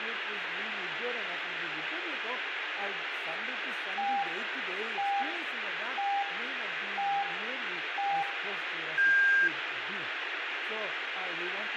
Radio time signal (five pips and a higher one, as on Chinese radio), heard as pips, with radio static and room echo.